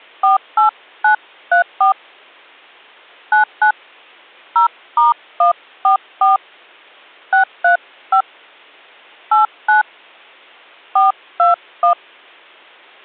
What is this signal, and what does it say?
DTMF, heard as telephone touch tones, dialled by hand, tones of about 110 ms. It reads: 48934 99 0*144 635 89 421